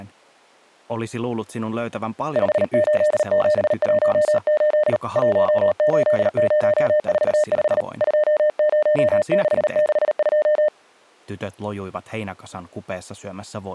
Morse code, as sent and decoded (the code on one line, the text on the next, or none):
..... ---.. --... .---- ---.. / .---- ---.. ----- ....- ..... / ..--- ----- -.... -.... ..---
58718 18045 20662